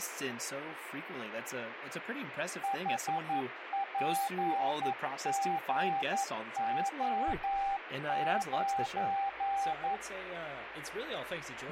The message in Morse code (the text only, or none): HPGO9